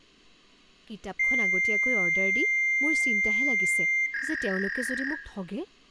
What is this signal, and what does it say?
Fax machine handshake, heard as a long tone and a warble, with room echo and speech in Assamese.